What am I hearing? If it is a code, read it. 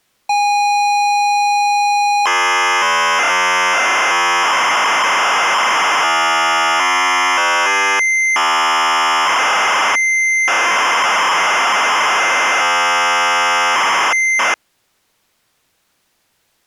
ZX Spectrum tape loading, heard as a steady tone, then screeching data.